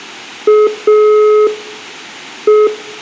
Telephone call progress tone (pulsed, as in Italy), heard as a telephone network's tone, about 420 Hz, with room echo. Dial tone.